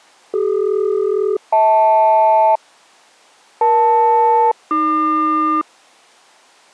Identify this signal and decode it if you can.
Aircraft SELCAL, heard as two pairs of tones. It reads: CD-HL EL-AQ